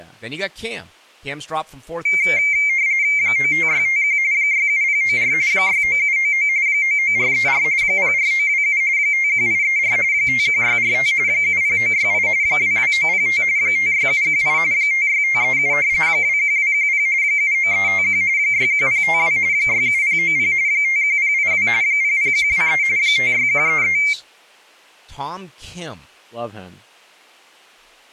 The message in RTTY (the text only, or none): 95651 67094 69799 99434 04927 51834 51645 70968 22905 56718 56537 21210 79351 61052 67090 51082 00123 56133